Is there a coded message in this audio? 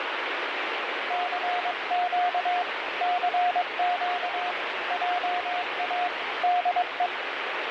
Yes: Morse code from 1.0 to 7.1 s, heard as a keyed tone, hand-sent with a paddle, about 22 wpm, 720 Hz, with heavy radio static. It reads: CQ CQ JA DE